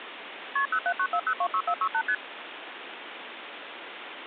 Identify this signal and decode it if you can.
Multi-frequency trunk signalling (R1, as on North American trunks), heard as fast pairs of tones, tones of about 70 ms, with phone line noise. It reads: KP 0794026468 ST